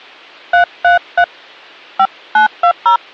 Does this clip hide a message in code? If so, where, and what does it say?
Yes: DTMF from 0.5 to 3.0 s, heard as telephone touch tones, dialled by hand, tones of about 90 ms. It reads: 333 5920